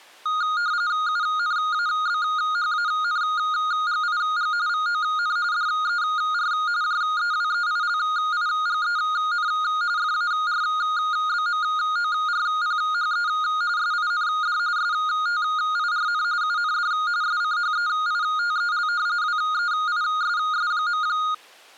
RTTY (45.45 baud, 170 Hz shift), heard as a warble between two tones, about 1330 Hz centre. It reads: UNABHANGIG VON DER JEWEILIGEN FARBMORPHE SIND STIRN UND SCHEITEL WEISS.